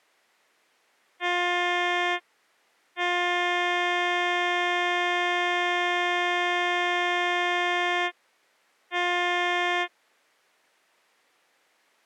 Ship horn signal, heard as a ship's horn, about 350 Hz. 1 short, 1 long, 1 short. At sea: a vessel at anchor warns of its position.